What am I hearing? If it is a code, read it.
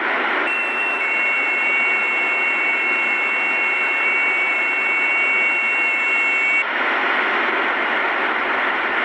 FT8 (several signals at once), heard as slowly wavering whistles, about 6.25 baud, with radio static.